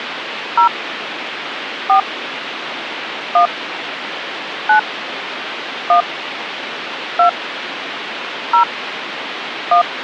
DTMF, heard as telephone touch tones, dialled by hand, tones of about 100 ms, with phone line noise. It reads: 0 4 1 9 1 2 0 1